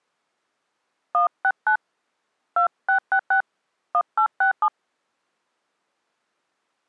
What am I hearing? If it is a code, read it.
DTMF, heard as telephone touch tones, dialled by hand, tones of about 90 ms. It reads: 169 2666 1867